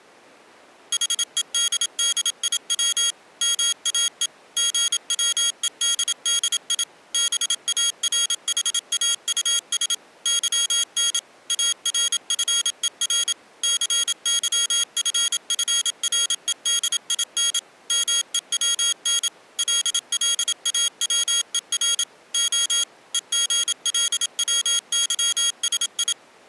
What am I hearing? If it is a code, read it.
Morse code, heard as a high beeper, machine-sent, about 27 wpm, 3300 Hz. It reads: HEDDIW MAE GWEDDI BARHAUS YN ARFER CYFFREDIN MEWN LLAWER O EGLWYSI